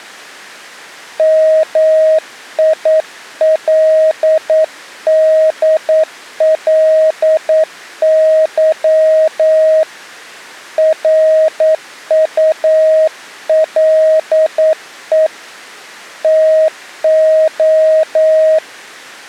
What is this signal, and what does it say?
Morse code, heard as a keyed tone, hand-sent with a paddle, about 9 wpm, 630 Hz. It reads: MILDLY RULE TO